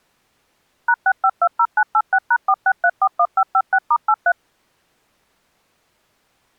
DTMF, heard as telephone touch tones, dialled by machine, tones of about 60 ms. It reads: #6520986#46341556*83